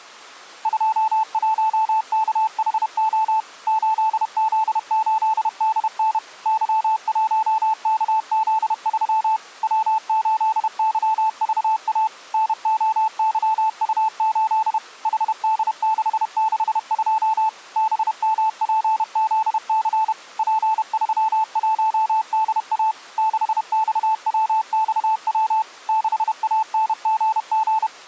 Morse code, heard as a keyed tone, machine-sent, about 31 wpm, 880 Hz. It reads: 21KHO 8Z8DN Y1KZ3 W8YVA NOYU8 HD662 BMPZC P31DA 6XWXW 6ANGG